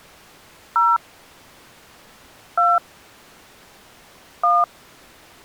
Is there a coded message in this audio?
Yes: DTMF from 0.8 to 4.6 s, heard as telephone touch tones, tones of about 210 ms. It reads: 0 2 1